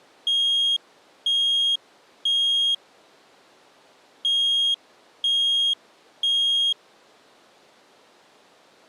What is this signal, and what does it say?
Alarm pattern, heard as an alarm's beeps, played twice, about 3250 Hz. Temporal three. Smoke or fire, evacuate.